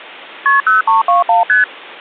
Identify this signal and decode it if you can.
Multi-frequency trunk signalling (R1, as on North American trunks), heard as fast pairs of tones, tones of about 140 ms. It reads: KP 0321 ST